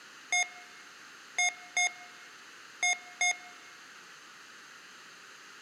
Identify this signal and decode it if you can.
Beep code, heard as beeps from a small speaker, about 720 Hz, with room echo. 1-2-2. In Phoenix BIOS tables: DMA initialisation failure.